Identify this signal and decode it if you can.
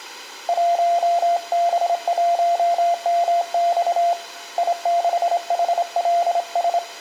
Morse code, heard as a keyed tone, hand-sent with a straight key, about 26 wpm, 690 Hz, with room echo. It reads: 1B1MX I6HLS